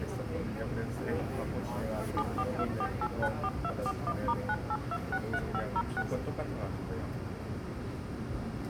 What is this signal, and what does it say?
DTMF, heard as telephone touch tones, dialled by machine, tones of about 60 ms, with the noise inside a subway train. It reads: 7424894241*98263506